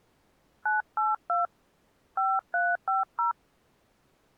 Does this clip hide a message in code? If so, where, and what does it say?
Yes: DTMF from 0.7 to 3.3 s, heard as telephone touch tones, dialled by hand, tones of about 150 ms. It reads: 982 5350